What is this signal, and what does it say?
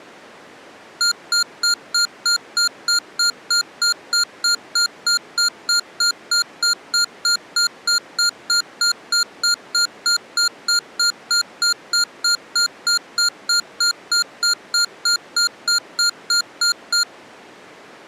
Evenly repeated beeps. There is no code.